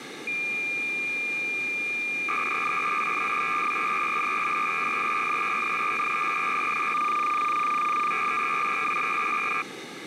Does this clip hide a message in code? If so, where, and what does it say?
Yes: cassette data (Kansas City type), 300 baud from 0.3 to 9.6 s, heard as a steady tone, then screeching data, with tape hiss.